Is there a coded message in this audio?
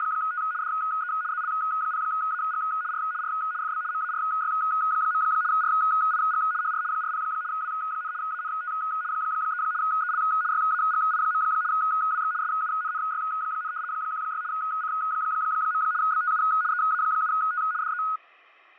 Yes: RTTY (75 baud, 170 Hz shift) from 0.0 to 18.2 s, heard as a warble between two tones, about 1360 Hz centre, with fading. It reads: … DE ZL0AG R R FB MARY. RIG HR 40 W, ANT 3 EL YAGI. WX SUNNY, 16 C. BTU EA7T DE